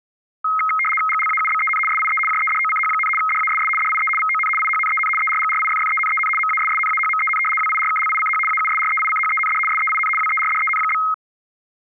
RTTY (75 baud, 850 Hz shift), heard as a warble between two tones, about 1700 Hz centre. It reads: GLAUBEN SIE JEDOCH, DASS DIE VON IHNEN ERGRIFFENEN MASSNAHMEN WIRKLICH AUSREICHEND SEIN WERDEN?